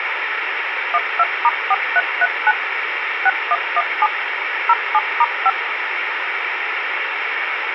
DTMF, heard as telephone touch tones, dialled by machine, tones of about 40 ms, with radio hiss and a squelch burst at the end. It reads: 12*4339 6117 07*5